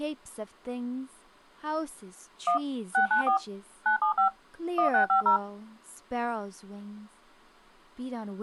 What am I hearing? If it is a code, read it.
DTMF, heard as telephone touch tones, dialled by machine, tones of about 110 ms, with speech in English. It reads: 1 694 975 1650